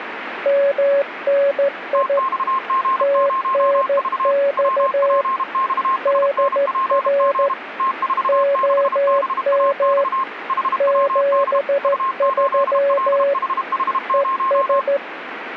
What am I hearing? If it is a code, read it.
Morse code, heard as two keyed tones, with radio static. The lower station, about 14 wpm, 560 Hz: MNI TNX DR OM 73 ES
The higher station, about 32 wpm, 1060 Hz: TXG0V WPXSNPG T46BAX HWD U8LHH0